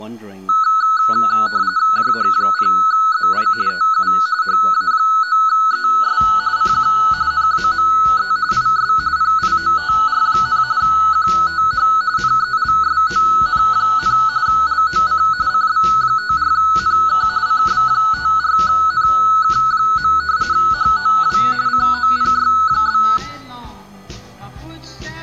RTTY (45.45 baud, 170 Hz shift), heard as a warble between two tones, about 1380 Hz centre. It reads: JH0ZI TU HA9ES CQ NAME IS PIOTR, QTH NELSON, LOC CB54NK CB54NK. HOW COPY?